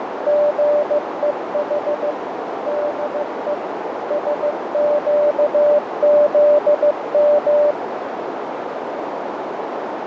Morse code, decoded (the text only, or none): GEH DE SQZM